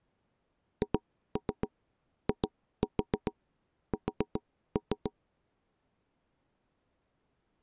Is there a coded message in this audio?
Yes: tap code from 0.8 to 5.1 s, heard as knocks on wood, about 7 knocks a second. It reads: HIS